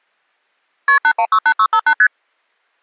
Multi-frequency trunk signalling (R1, as on North American trunks), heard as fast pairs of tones, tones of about 70 ms. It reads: KP 8168658 ST